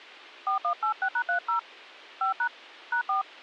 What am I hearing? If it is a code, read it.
DTMF, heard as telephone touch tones, dialled by hand, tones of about 100 ms. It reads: 4186#30 5# #4